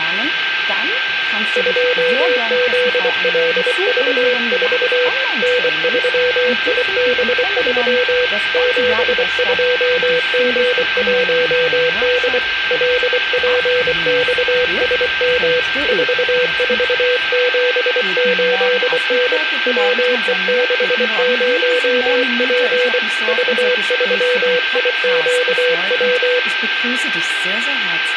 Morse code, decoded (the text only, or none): 2ZLV4 N3IB3 72G1D LPXSM 4478N WE60P V3IQW